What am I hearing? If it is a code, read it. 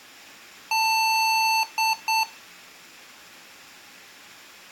Beep code, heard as beeps from a small speaker, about 890 Hz, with room echo. 1 long, 2 short. In Award, IBM and AMI BIOS tables: video adapter failure.